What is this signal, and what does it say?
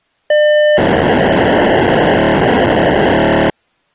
POCSAG pager data (1200 baud), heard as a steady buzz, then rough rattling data.